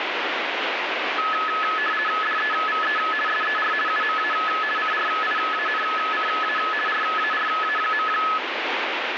RTTY (50 baud, 450 Hz shift), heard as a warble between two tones, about 1500 Hz centre, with radio static. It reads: DEVE SER UMA CRIANCA RARA.